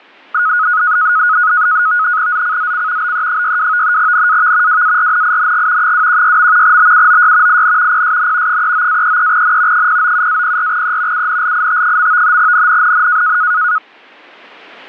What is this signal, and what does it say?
NAVTEX (SITOR-B), 100 baud, 170 Hz shift, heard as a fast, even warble, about 1360 Hz centre. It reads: ZCZC BE62 NAV WARNING 216. BUOY IN PSN 39-33N 097-04E UNLIT. NNNN